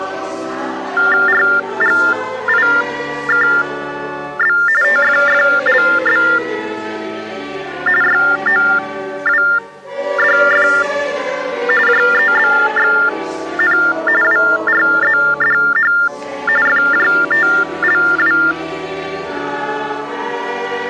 TTY/TDD text telephone tones (45.45 baud Baudot), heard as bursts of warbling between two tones, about 400 Hz shift, 1600 Hz centre. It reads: RGIKB TFFLB YOWDF JEBXN WRZDH FJTLW